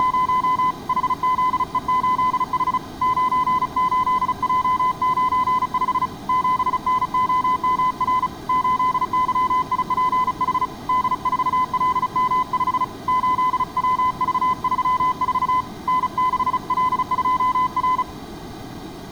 Morse code, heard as a keyed tone, hand-sent with a paddle, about 35 wpm, 1010 Hz. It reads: … HZE8H 98J95 7NOMR 8YIPH D4LM5 8WV34 N6L2R